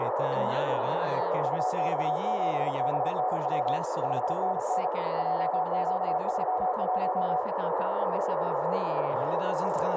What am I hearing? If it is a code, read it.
Morse code, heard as a keyed tone, hand-sent with a paddle, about 37 wpm, 740 Hz, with radio static and a narrow filter. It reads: UX7BNW 5NN JQ31